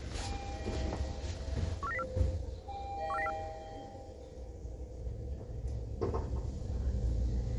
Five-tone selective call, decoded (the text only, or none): 14904 14904